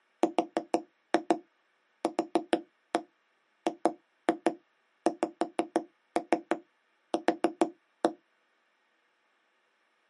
Tap code, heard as taps on a table, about 6 knocks a second. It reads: RQGXQ